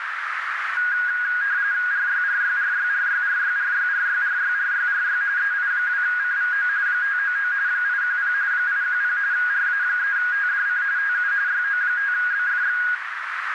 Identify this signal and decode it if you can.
RTTY (45.45 baud, 170 Hz shift), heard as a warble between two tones, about 1550 Hz centre, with radio static and a narrow filter. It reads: RYRYRYRYRYRYRYRYRYRY EI2CVO 599 810 810 RA3TDC TU YO5BFX